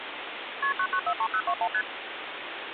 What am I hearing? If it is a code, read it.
Multi-frequency trunk signalling (R1, as on North American trunks), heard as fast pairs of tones, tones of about 70 ms, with phone line noise. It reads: KP 9943021 ST